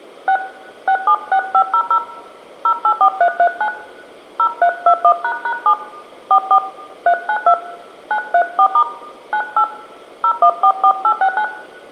DTMF, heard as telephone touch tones, dialled by hand, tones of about 80 ms, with room echo. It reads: 6 676500 084339 0321##7 44 392 934* 98 0144869